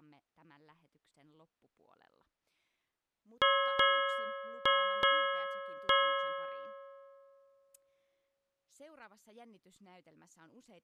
Ship's bell, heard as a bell, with speech in Finnish. 5. Five half-hours of the watch have passed.